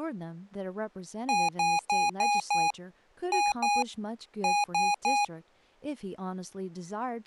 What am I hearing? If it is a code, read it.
Beep code, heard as beeps from a small speaker, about 820 Hz, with speech in English. 5-2-3.